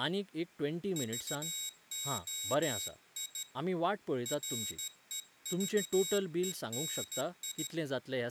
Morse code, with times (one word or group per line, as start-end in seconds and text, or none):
1.0-3.4 VOI
4.3-7.7 REVENI